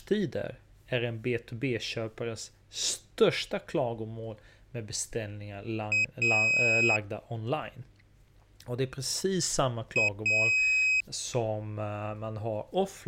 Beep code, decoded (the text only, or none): 1 short, 1 long